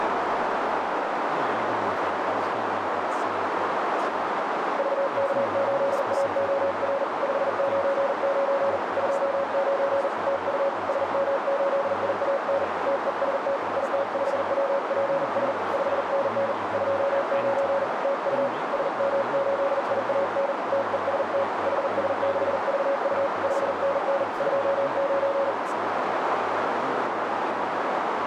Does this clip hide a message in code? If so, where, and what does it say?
Yes: Morse code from 4.7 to 25.6 s, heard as a keyed tone, hand-sent with a paddle, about 40 wpm, 550 Hz, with heavy radio static, a narrow filter and speech in English. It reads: VK8AOR 599 29 TU SM8IAN TEST IT5WPS 5NN 29 TU SM8IAN TEST HS6VU 5NN 29